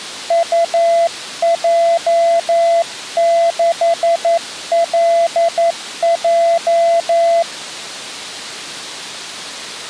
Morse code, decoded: UJ6LJ

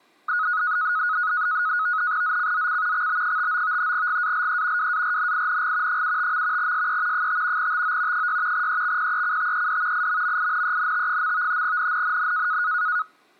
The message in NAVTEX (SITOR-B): ZCZC XB59 GALE WARNING 75. SE 5 TO 6 EXPECTED IMMINENT. NNNN

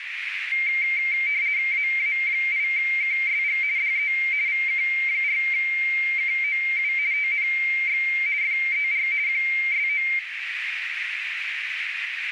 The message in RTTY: AA8KSG DE VK4KOU TNX FER QSO

